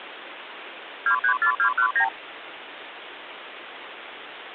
Multi-frequency trunk signalling (R2, with the far end's replies), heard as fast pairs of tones, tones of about 90 ms, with phone line noise. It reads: 234219